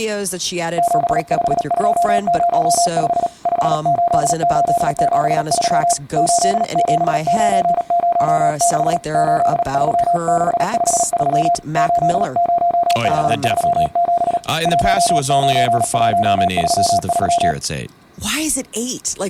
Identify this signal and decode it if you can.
Morse code, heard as a keyed tone, hand-sent with a paddle, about 37 wpm, 690 Hz, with speech in English. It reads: 75205 58873 87906 83653 80537 19133